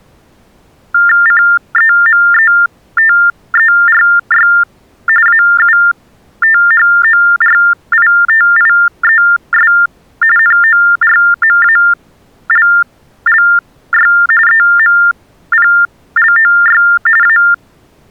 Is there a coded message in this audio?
Yes: TTY/TDD text telephone tones (45.45 baud Baudot) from 0.9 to 17.5 s, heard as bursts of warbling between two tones, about 400 Hz shift, 1600 Hz centre. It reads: CEMETERY AUTHORITIES NORMALLY EMPLOY A